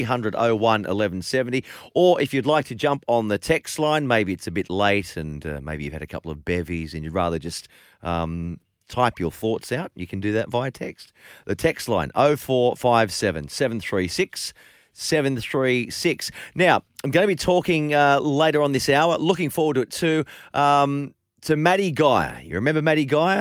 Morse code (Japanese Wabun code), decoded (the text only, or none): none